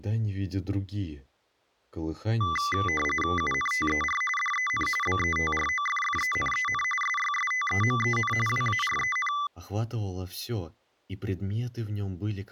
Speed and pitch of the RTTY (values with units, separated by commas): 45.45 baud, 850 Hz shift, 1600 Hz centre